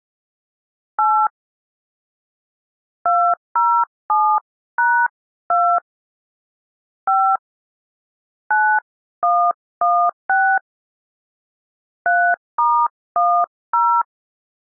DTMF, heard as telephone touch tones, dialled by hand, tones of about 280 ms. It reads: 8 207#2 5 9116 3*10